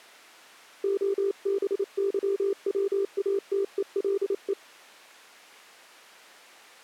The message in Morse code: OBYWATELE

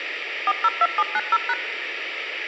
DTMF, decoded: 402790#

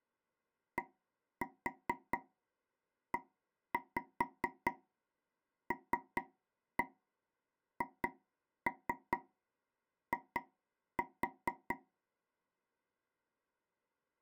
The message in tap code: DELHI

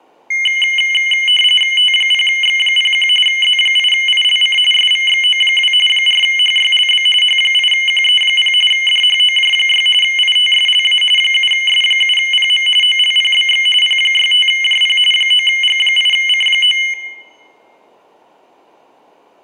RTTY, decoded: T0X01 Z8ILC SVXO2 4HYLB H8QE0 DHOJ6 ITSLA 7S7PM OLPBX P65JP 9G8C9

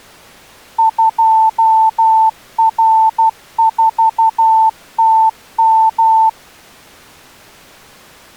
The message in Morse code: 2R4TM

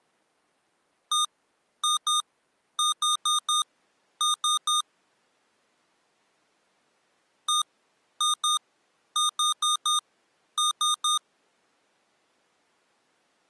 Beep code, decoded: 1-2-4-3

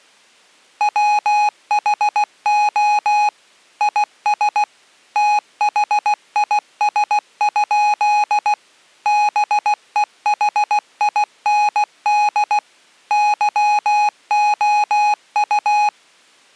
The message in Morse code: WHO IS THIS? BEHIND YOU

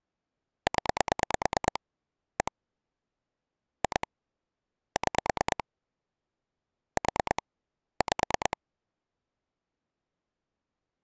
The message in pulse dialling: 0 1 2 6 4 5

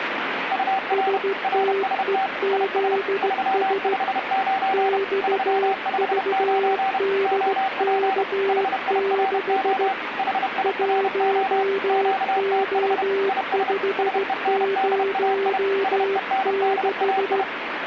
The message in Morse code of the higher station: UR RST IS 359 359 OP HIRO HIRO QTH IS SENDAI SENDAI

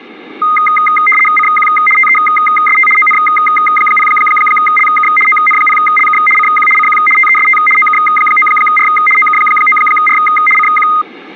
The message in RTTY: CQ TEST ON0LK ON0LK CQ CQ TEST OK9R OK9R CQ

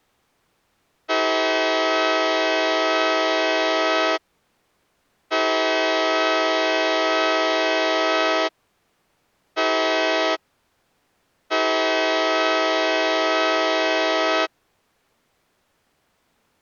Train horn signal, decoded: 2 long, 1 short, 1 long

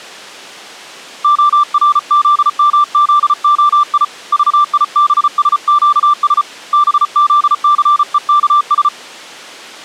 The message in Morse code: ORZMZOI VIBSQS BZCEKS

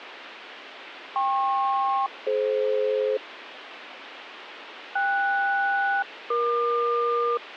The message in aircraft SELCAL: KP-DF KS-EQ

